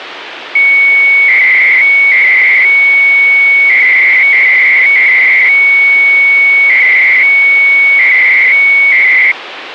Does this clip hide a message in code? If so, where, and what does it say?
Yes: 300-baud modem data (Bell 103 tones) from 0.6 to 9.3 s, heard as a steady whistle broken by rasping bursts, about 300 baud, 200 Hz shift, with phone line noise.